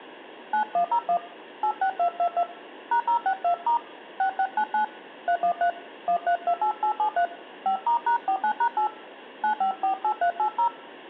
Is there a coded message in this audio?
Yes: DTMF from 0.5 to 10.7 s, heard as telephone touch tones, dialled by hand, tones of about 80 ms. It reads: 9101 86222 #062* 6699 313 1328873 5*#49#8 9548380